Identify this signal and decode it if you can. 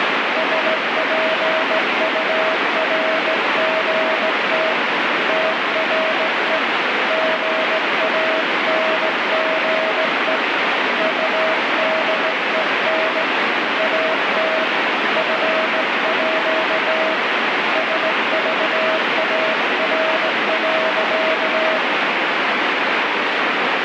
Morse code (with Danish letters), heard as a keyed tone, hand-sent with a straight key, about 17 wpm, 640 Hz, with heavy radio static. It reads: SPURGT TRE GANGE UDEN AT FÅ SVAR.